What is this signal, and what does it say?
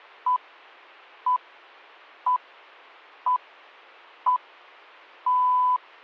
Radio time signal (six pips, as the Greenwich Time Signal), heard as pips.